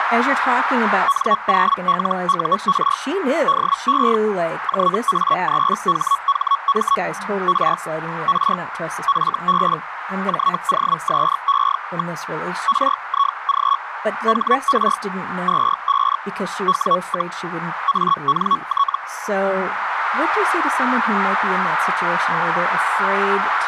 Hellschreiber (Feld-Hell, 122.5 baud), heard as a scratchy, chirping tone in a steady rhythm, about 1120 Hz, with radio static, a narrow filter and speech in English. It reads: N0LUR DE JA3HHM R R FB JOSE. RIG HR 25 W, ANT